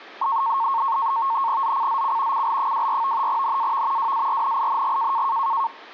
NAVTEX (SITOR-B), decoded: ZCZC CL24 NAV WARNING

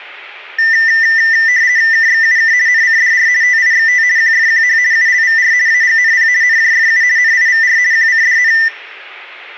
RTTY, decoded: KXUK NCDR TIXT QFQH ULVR AGNP NJFU NIVR QCDN

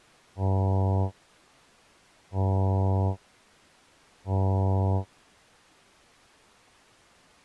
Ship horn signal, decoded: 3 short

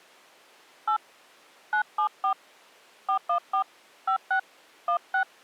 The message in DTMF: 8 974 414 56 16

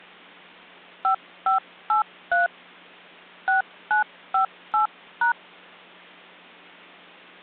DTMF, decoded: 5583 6958#

